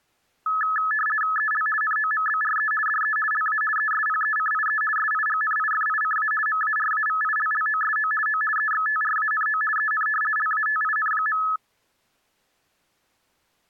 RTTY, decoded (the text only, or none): EL NOMBRE DE LA ESPECIE SIGNIFICA MARAVILLOSO O EXTRANO EN LATIN.